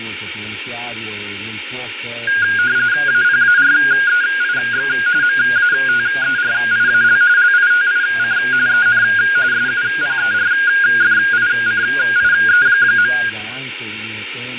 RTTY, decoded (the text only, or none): APAREIX MATERIAL LITIC EN SUPERFICIE.